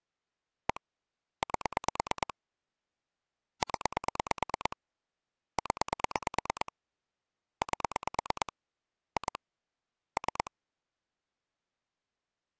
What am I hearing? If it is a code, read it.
Pulse dialling, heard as clicks on a phone line, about 9 pulses a second. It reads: 1 8 0 0 8 2 3